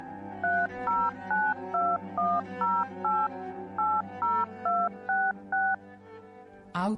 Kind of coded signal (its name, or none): DTMF